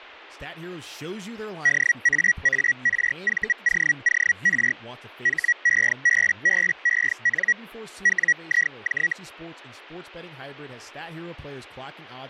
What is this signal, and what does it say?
Hellschreiber (Feld-Hell, 122.5 baud), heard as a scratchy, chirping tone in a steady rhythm, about 1900 Hz, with speech in English. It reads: DAARVOOR HEBBEN WIJ